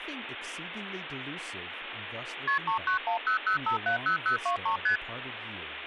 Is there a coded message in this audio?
Yes: multi-frequency trunk signalling (R1, as on North American trunks) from 2.5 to 5.0 s, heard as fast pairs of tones, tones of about 110 ms, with phone line noise and speech in English. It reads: KP 39100570023 ST